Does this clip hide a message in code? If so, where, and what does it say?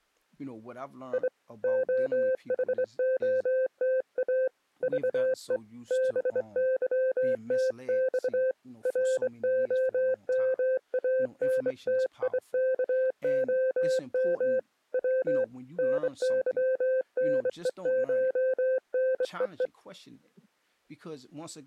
Yes: Morse code (Russian alphabet) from 1.1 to 19.7 s, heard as a keyed tone, hand-sent with a straight key, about 24 wpm, 520 Hz, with speech in English. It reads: И ОХОТА ЖЕ БЫТЬ РОМАНТИКОМ В НЫНЕШНЕЕ